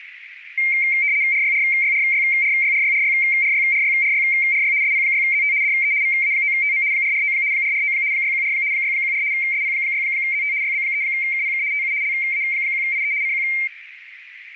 RTTY (75 baud, 170 Hz shift), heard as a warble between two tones, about 2200 Hz centre, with radio static and a narrow filter. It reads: RYRYRYRYRYRYRYRYRYRY SP6ZT DE VA9TM 449 449 614 614 SP6ZT YB3KPK TU LA1IE CQ